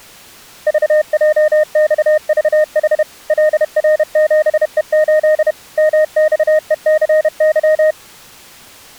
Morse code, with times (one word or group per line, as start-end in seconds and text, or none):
0.7-3.0 VJXVH
3.3-5.5 LR7E8
5.8-7.9 MXECY